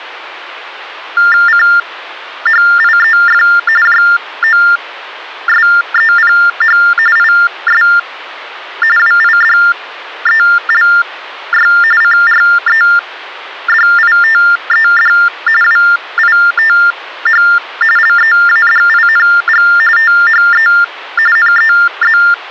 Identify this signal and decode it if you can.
TTY/TDD text telephone tones (45.45 baud Baudot), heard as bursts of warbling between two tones, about 400 Hz shift, 1600 Hz centre. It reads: CHIEF JOSEPH IS WIDELY CREDITED WITH LEADING THE NEZ